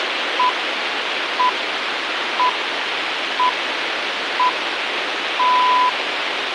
Radio time signal (six pips, as the Greenwich Time Signal), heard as pips, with radio hiss.